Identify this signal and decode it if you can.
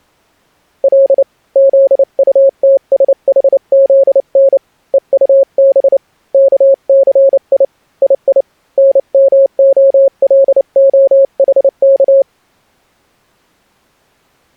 Morse code (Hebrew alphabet), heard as a keyed tone, hand-sent with a paddle, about 29 wpm, 540 Hz. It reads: ל זטתשחזן וטב כסי יי נמהלהחך